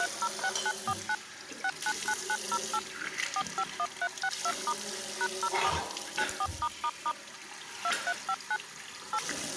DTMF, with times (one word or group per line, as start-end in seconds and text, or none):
0.0-1.1 306949
1.6-2.8 699908
3.4-4.7 451362*
5.2-5.7 #04
6.2-7.1 94***
7.8-8.6 2359
9.1-9.2 8